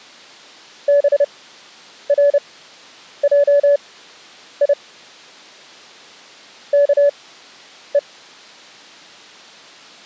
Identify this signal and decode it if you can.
Morse code (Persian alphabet), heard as a keyed tone, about 30 wpm, spaced as for 9 wpm, 570 Hz. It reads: برجی که